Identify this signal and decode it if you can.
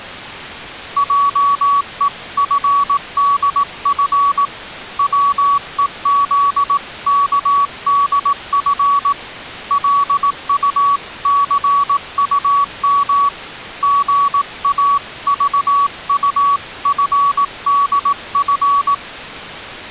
Morse code (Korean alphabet), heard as a keyed tone, hand-sent with a paddle, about 18 wpm, 1130 Hz. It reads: 하는 밭은 기침 소리는